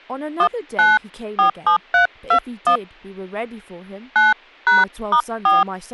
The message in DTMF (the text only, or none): 1947321 9#*4